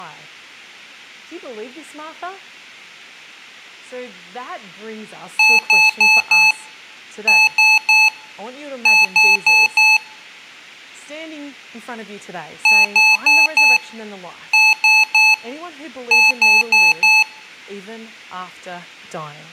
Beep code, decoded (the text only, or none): 4-3-4